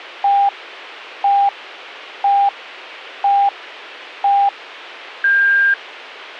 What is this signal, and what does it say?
Radio time signal (five pips and a higher one, as on Chinese radio), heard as pips.